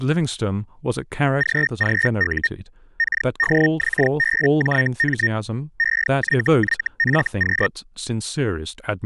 Hellschreiber (Feld-Hell, 122.5 baud), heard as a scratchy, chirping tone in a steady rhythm, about 1850 Hz, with speech in English. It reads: GGU KDXBJM EYYFQ